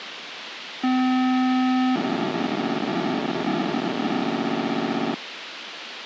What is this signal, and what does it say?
POCSAG pager data (512 baud), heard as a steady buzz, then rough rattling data, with radio hiss.